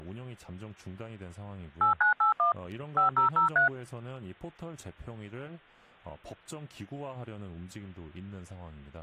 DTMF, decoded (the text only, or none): 8981 5003